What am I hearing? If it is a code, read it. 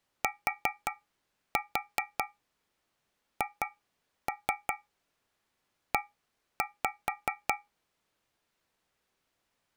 Tap code, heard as taps on a metal pipe, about 5 knocks a second. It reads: THE